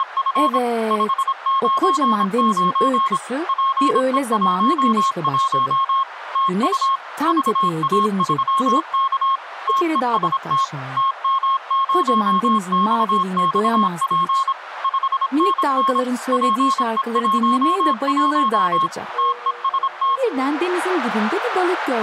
Morse code, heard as a keyed tone, machine-sent, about 26 wpm, 1080 Hz, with radio static. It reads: … 599 PE11 TU VA3K TEST TM0XXP 5NN PE11 TEST